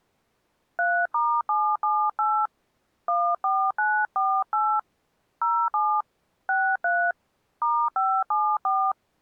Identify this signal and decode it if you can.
DTMF, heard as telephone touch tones, dialled by hand, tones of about 270 ms. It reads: 3*778 14948 07 63 *574